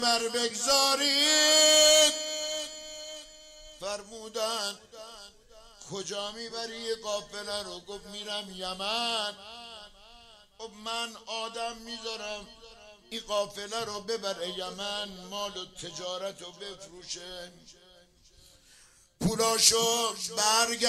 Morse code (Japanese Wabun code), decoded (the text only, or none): none